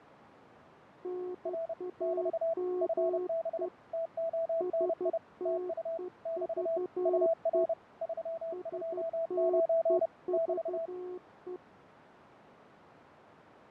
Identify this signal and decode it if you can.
Morse code, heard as two keyed tones, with radio static and fading. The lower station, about 12 wpm, 360 Hz: NAME STEVE STEVE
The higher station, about 30 wpm, 660 Hz: R <BT> FB TONI TU <BT> UR 329 <BT>